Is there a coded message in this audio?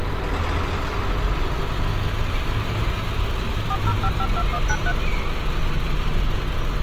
Yes: DTMF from 3.7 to 4.9 s, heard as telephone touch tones, dialled by machine, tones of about 60 ms, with street noise. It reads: 40552193